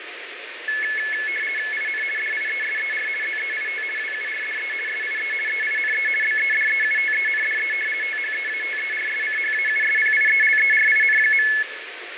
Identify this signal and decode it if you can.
RTTY (50 baud, 450 Hz shift), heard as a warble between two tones, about 1950 Hz centre, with radio static and fading. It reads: IN DIESER ZEIT WURDE SIE EINE BEDEUTENDE THEATERSCHAUSPIELERIN.